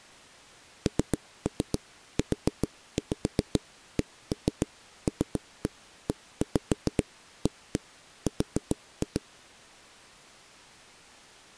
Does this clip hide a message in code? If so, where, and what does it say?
Yes: tap code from 0.9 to 9.2 s, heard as knocks on wood, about 7 knocks a second. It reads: NUCLEAR